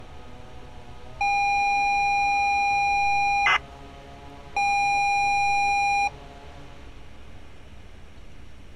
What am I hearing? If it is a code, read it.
ZX Spectrum tape loading, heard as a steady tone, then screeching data, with street noise.